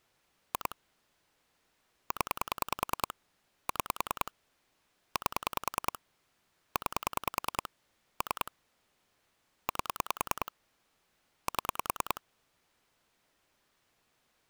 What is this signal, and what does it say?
Pulse dialling, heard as clicks on a phone line, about 10 pulses a second. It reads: 2 0 6 8 9 3 8 7